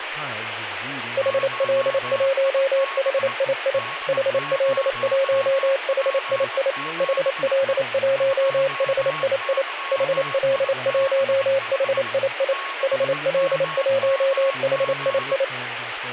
Morse code, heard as a keyed tone, machine-sent, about 28 wpm, 540 Hz, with radio static, a weaker station near 1100 Hz and speech in English. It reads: HL1HII HL1HII HL1HII HL1HII HL1HII